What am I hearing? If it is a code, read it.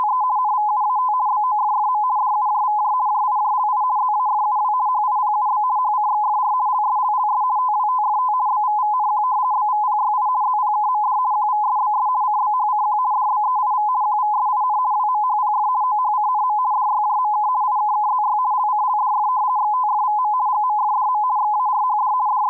RTTY (50 baud, 170 Hz shift), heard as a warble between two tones, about 930 Hz centre. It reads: … NVUAT BOFFM DUJVJ JIJLI ZAFUW HIPUB HCXFR LSLLS TWTFT BVVNQ BVPYI ZPKMD QVSBS CBHCQ DBEIV QVSIN WMHPF OHCNM DYJMK IKKZY LCLDF XTFVM GMFDM XARHD …